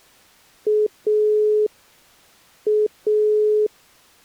Telephone call progress tone (pulsed, as in Italy), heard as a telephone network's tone, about 420 Hz. Dial tone.